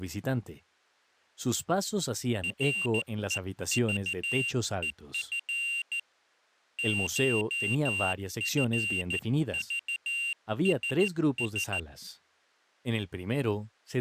Morse code (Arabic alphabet), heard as a high beeper, hand-sent with a straight key, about 14 wpm, 2750 Hz, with speech in Spanish. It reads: رءضءف شفضسس